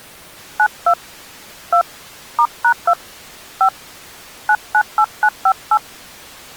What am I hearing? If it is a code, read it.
DTMF, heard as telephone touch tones, dialled by hand, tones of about 80 ms. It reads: 92 2 *#2 5 998958